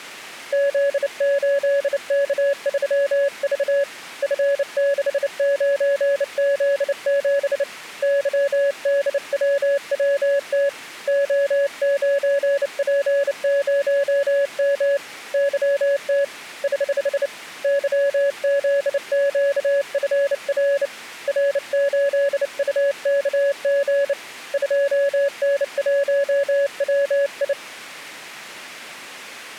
Morse code, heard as a keyed tone, hand-sent with a bug key, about 29 wpm, 560 Hz. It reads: Z8K3V F69Z7 YDWWT O9P0M YT <HH> YZQFR R8UKG 2N1WI